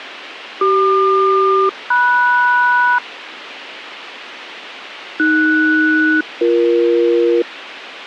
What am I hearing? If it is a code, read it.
Aircraft SELCAL, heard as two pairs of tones, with radio hiss and a squelch burst at the end. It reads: CQ-MS AS-BE